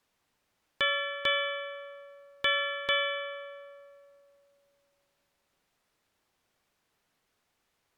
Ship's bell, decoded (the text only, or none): 4